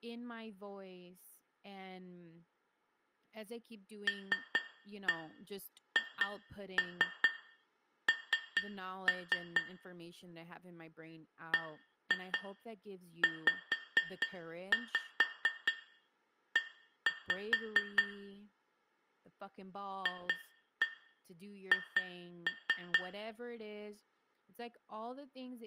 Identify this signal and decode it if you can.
Tap code, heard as taps on glass, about 4 knocks a second, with room echo and speech in English. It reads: LHN BZE FH